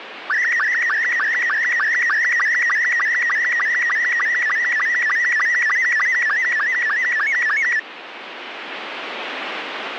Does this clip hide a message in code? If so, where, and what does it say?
Yes: SSTV (slow-scan television), Robot 72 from 0.3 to 7.8 s, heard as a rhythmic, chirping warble, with radio static.